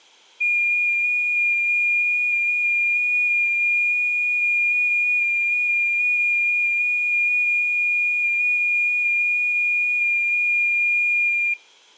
FT8 (one signal), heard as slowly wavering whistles, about 6.25 baud.